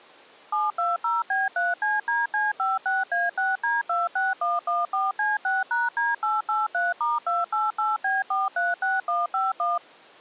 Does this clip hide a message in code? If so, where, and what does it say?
Yes: DTMF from 0.5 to 9.8 s, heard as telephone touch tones, dialled by machine, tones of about 180 ms. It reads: 720B3CDC56A6D26114C6#D883*288B436151